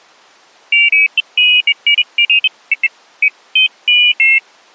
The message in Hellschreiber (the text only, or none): none